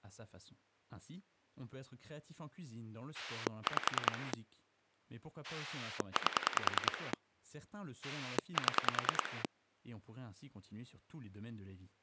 Pulse dialling, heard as a rotary dial, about 10 pulses a second, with speech in French. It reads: 5 8 7